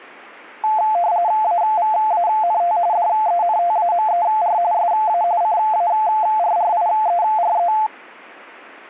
RTTY (45.45 baud, 170 Hz shift), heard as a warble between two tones, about 780 Hz centre. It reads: AVANT DENTAMER SA CARRIERE